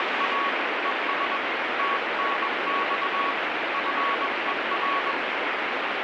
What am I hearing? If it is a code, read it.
Morse code, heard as a keyed tone, hand-sent with a paddle, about 21 wpm, 1120 Hz, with heavy radio static. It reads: … ES TNX FER